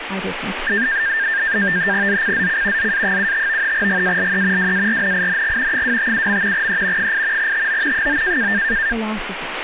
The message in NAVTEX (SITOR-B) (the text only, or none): ZCZC ZA75 GALE WARNING 257. E 8 TO 9